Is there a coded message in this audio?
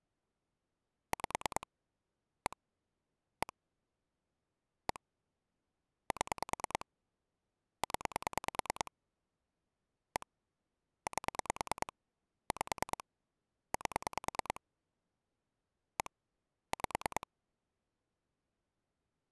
Yes: pulse dialling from 1.1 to 17.2 s, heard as clicks on a phone line, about 9 pulses a second. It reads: 5 1 1 1 7 0 1 8 5 8 1 5